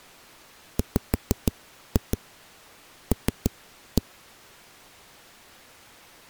Tap code, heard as knocks on a wall, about 6 knocks a second. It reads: WL